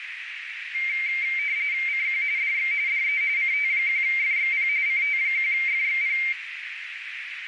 RTTY (45.45 baud, 170 Hz shift), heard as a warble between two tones, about 2200 Hz centre, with radio static and a narrow filter. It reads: CQ DX DE CT1FXP CT1FXP